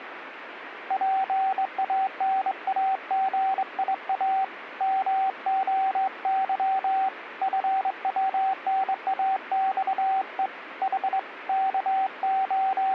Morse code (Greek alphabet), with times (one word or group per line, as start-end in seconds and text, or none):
0.9-4.4 ΠΑΝΑΓΙΑ
4.8-7.1 ΜΟΥ
7.4-10.5 ΦΩΝΑΞΕ
10.8-11.2 Η
11.5-12.9 …